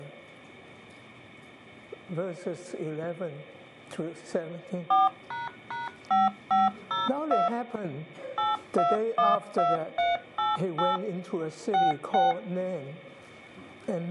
DTMF, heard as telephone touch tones, dialled by machine, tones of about 170 ms. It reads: 4##5502 8212388 66